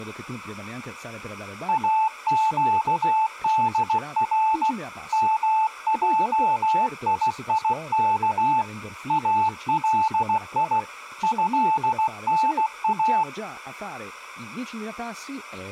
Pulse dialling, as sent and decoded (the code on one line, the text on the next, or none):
none